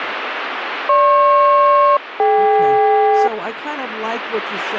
Aircraft SELCAL, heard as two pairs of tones, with radio static and speech in English. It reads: GP-DK